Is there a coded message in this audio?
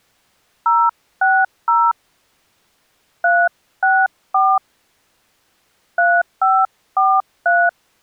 Yes: DTMF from 0.7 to 7.7 s, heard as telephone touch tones, dialled by hand, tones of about 240 ms. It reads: 060 364 3543